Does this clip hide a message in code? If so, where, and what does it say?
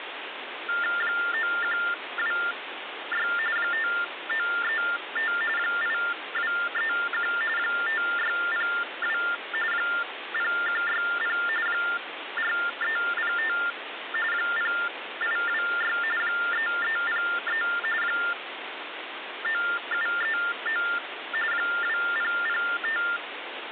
Yes: TTY/TDD text telephone tones (45.45 baud Baudot) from 0.7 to 23.2 s, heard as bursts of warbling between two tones, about 400 Hz shift, 1600 Hz centre, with phone line noise. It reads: 9126 5935 8231 5602 0160 4305 0826 3303 9739 2005